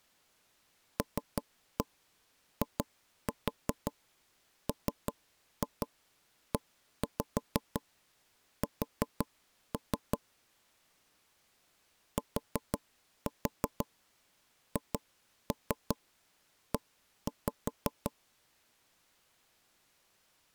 Tap code, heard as knocks on wood, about 5 knocks a second. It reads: LIMES THE